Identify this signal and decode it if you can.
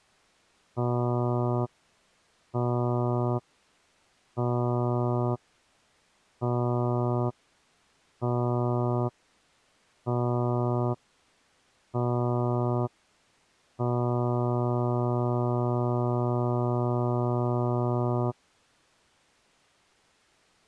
Ship horn signal, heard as a ship's horn, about 120 Hz. 7 short, 1 long. At sea: general emergency alarm.